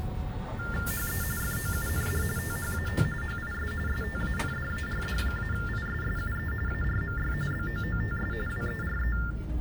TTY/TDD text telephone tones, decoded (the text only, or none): HE FOUND THAT HIS STANDARD-ISSUE ARMY BOOTS WERE